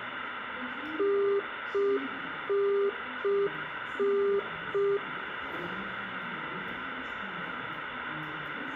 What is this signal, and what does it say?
Telephone call progress tone (UK plan), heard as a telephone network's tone, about 400 Hz, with room echo and the noise of a subway station. Congestion tone.